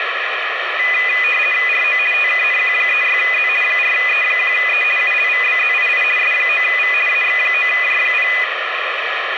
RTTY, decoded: RO TKNQ36Z 4E1E ULVBZII S9V AX9J0

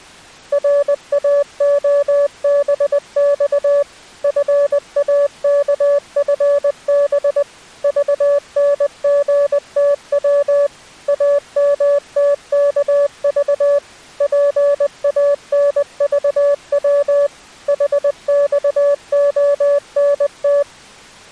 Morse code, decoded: RAOBX FAKFB VNGTW AMTKV PANVW HXONT

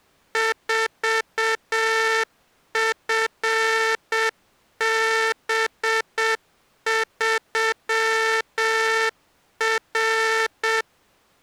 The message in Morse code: 4FB3R

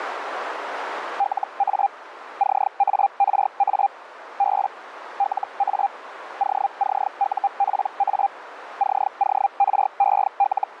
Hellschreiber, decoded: LA CARA B LA OCUPA …

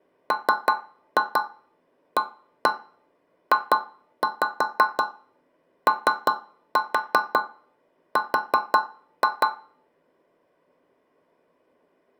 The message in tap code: MAJOR

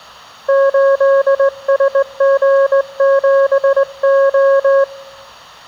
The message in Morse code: 8SG7O

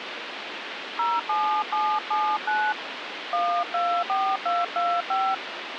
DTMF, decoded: 07779 124225

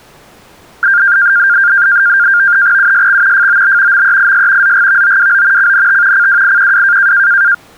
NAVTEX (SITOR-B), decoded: USX FOB MEIS ZGVOWO CNT CWIQW

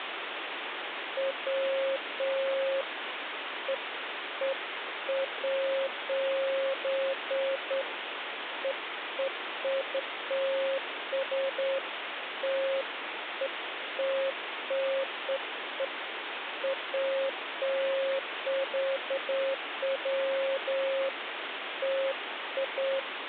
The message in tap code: none

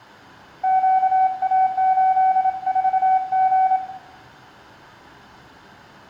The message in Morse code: QA84G

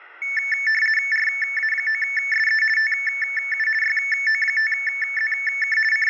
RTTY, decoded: RA9SE TU YO5ZK …

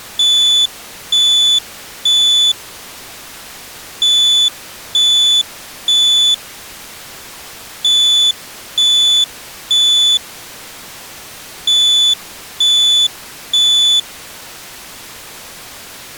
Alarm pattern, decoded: temporal three

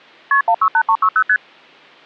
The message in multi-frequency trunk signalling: KP 168360 ST

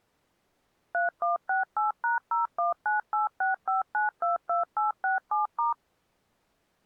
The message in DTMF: 3168#019865922867*

